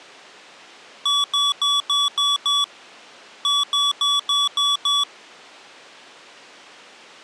Beep code, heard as beeps from a small speaker, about 1140 Hz. 6-6.